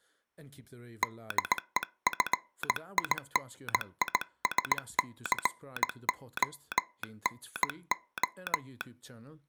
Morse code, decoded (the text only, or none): DEFINISCONO